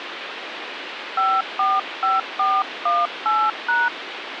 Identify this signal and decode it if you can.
DTMF, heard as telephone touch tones, dialled by hand, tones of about 210 ms, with phone line noise. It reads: 545418#